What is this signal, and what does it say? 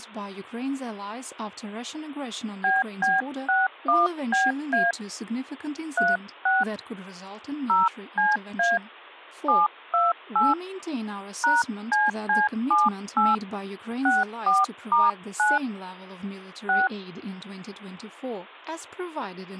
DTMF, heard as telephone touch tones, dialled by hand, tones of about 180 ms, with speech in English. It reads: BB61BA 36 0CA 728 #CC78 64*9 6